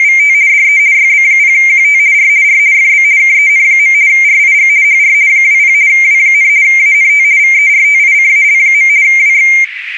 RTTY (50 baud, 170 Hz shift), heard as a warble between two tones, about 2200 Hz centre, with radio static. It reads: … DE YB0QT R R FB KEN. RIG HR 20 W, ANT VERTICAL. WX